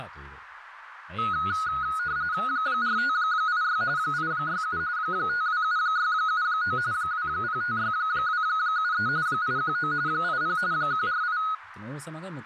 RTTY (45.45 baud, 170 Hz shift), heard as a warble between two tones, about 1360 Hz centre, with radio static and speech in Japanese. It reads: 4586 867 527679 2056273 819 80 148